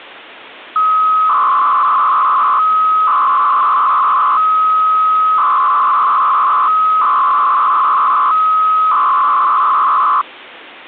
300-baud modem data (Bell 103 tones), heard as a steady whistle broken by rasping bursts, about 300 baud, 200 Hz shift.